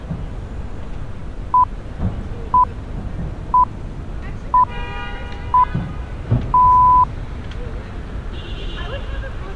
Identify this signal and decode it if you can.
Radio time signal (six pips, as the Greenwich Time Signal), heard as pips, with street noise.